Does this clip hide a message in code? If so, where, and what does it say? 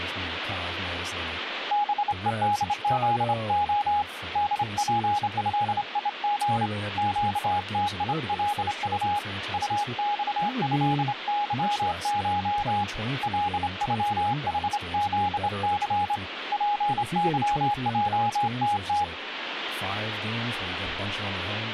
Yes: Morse code (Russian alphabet) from 1.7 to 19.1 s, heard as a keyed tone, hand-sent with a straight key, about 27 wpm, 830 Hz, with radio static and speech in English. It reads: БЕДЗО ДПЭИГ ЩТИЛУ УЬЭЫШ ЛЮХЗЦ ПЫЙТТ